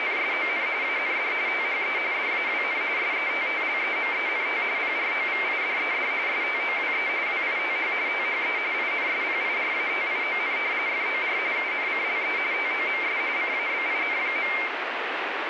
RTTY (45.45 baud, 170 Hz shift), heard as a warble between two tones, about 2200 Hz centre, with radio static. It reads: … AND THE DAWN SETTLEMENT PROVIDED STOWE WITH THE INSPIRATION FOR UNCLE TOMS CABIN.